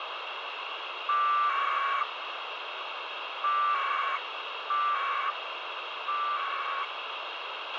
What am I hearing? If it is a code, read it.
Packet radio (AX.25, as in APRS), 1200 baud, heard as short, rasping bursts, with radio hiss and a squelch burst at the end.